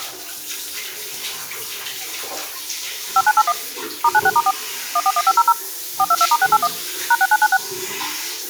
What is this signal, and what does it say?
DTMF, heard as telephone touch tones, dialled by machine, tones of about 50 ms, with the noise of a restroom. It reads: 5981 *96*4 141500 422*681 #6996